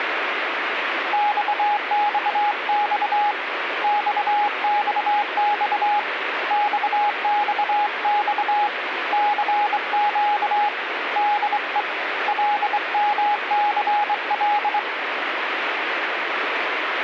Morse code, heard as a keyed tone, hand-sent with a straight key, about 24 wpm, 830 Hz, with radio static. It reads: XXX XXX XXX CQ DE LMCL